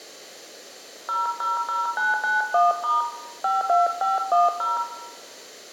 DTMF, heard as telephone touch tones, dialled by hand, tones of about 170 ms, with room echo. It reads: 000991* 52510